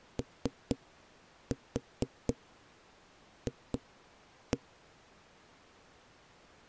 Tap code, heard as knocks on a wall, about 4 knocks a second. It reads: OF